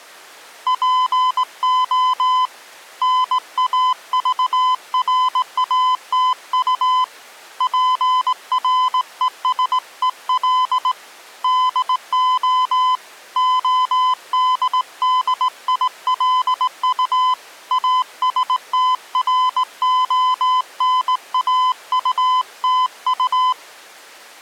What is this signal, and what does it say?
Morse code, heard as a keyed tone, hand-sent with a straight key, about 18 wpm, 1010 Hz. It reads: PO NAVRATU PRESEL DO ODDILU ASTRONAUTU